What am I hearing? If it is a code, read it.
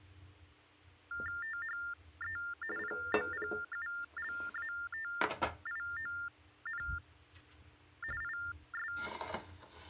TTY/TDD text telephone tones (45.45 baud Baudot), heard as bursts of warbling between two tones, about 400 Hz shift, 1600 Hz centre, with kitchen noise. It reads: THE POPULATION IS